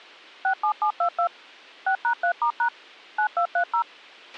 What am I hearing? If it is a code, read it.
DTMF, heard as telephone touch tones, dialled by machine, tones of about 90 ms, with a squelch burst at the end. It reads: 67722 6#3*# 9230